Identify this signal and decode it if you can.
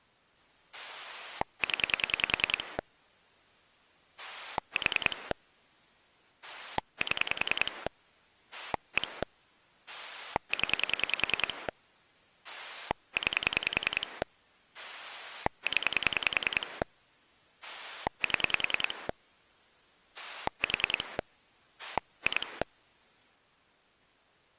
Pulse dialling, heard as a rotary dial, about 10 pulses a second. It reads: 0 4 7 1 0 9 0 7 4 2